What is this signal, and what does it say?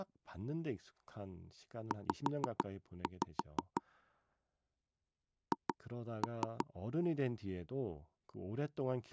Tap code, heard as taps on a table, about 6 knocks a second, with speech in Korean. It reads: Z H